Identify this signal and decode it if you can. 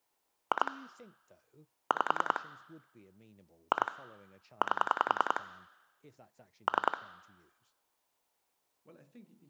Pulse dialling, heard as clicks on a phone line, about 10 pulses a second, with speech in English. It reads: 2 5 2 8 3